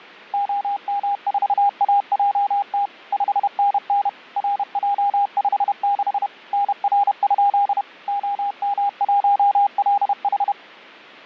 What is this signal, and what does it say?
Morse code, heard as a keyed tone, machine-sent, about 31 wpm, 810 Hz. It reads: OM4AJT 5NN RJ56 NR? OM1LH